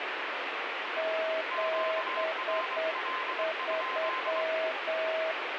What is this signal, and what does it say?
Morse code, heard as two keyed tones, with radio static. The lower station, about 8 wpm, 640 Hz: 73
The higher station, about 23 wpm, 1040 Hz: QRL?